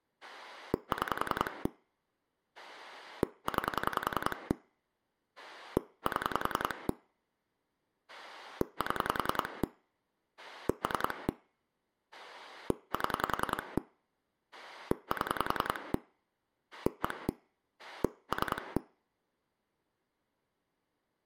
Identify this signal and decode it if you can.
Pulse dialling, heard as a rotary dial, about 10 pulses a second, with room echo. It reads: 6 9 7 7 3 7 7 1 3